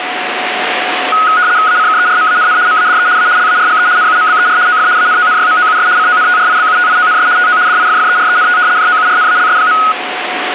RTTY (75 baud, 170 Hz shift), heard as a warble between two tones, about 1360 Hz centre, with radio static and a steady whistle near 730 Hz. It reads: ACKERMANN MADE A LARGE NUMBER OF ANONYMOUS CONTRIBUTIONS TO DIFFERENT JOURNALS.